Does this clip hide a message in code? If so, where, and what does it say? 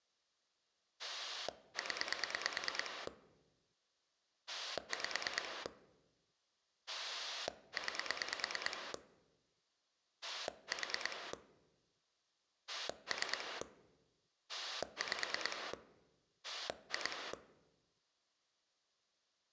Yes: pulse dialling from 1.0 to 17.3 s, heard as a rotary dial, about 9 pulses a second. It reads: 0 5 9 4 3 5 2